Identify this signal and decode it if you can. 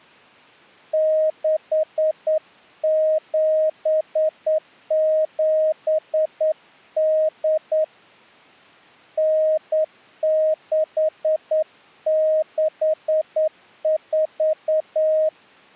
Morse code (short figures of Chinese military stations), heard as a keyed tone, hand-sent with a straight key, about 9 wpm, 620 Hz. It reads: 6778 9664